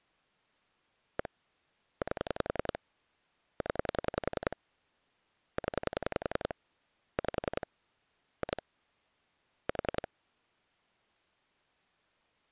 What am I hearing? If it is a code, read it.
Pulse dialling, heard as clicks on a phone line, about 10 pulses a second. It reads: 1 8 0 0 5 2 4